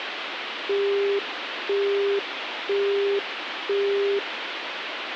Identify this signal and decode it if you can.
Telephone call progress tone (single-tone plan, as in Europe, Japan and elsewhere), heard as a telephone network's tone, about 400 Hz, 0.5 s on and 0.5 s off, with phone line noise. Busy tone.